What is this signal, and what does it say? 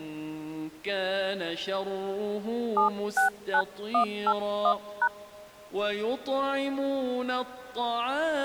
DTMF, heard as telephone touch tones, dialled by hand, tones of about 90 ms. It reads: 769181#